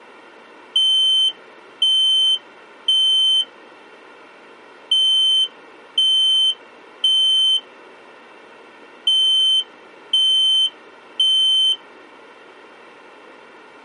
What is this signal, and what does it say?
Alarm pattern, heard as an alarm's beeps, played three times, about 3100 Hz. Temporal three. Smoke or fire, evacuate.